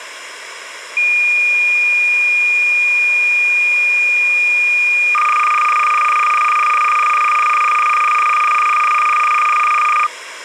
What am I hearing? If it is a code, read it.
Cassette data (Kansas City type), 300 baud, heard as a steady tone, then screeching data, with tape hiss.